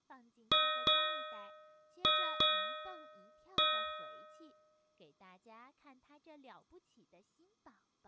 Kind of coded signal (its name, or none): ship's bell